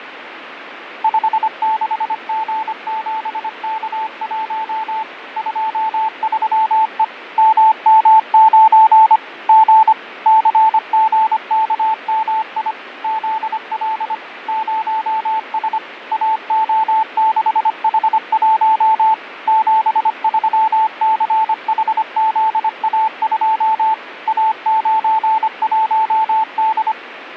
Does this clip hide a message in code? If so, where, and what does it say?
Yes: Morse code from 1.0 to 27.0 s, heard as a keyed tone, machine-sent, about 25 wpm, 880 Hz, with radio static and fading. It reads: 56G7K1 23E MM9 G CGKMI ZL 0S AO6H1 73CHZA2 A91D